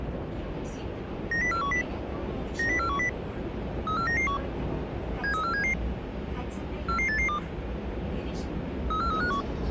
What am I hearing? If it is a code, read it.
Five-tone selective call (CCIR), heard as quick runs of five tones, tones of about 100 ms, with the noise inside a subway train. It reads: 90410 90410 34991 73477 44882 34351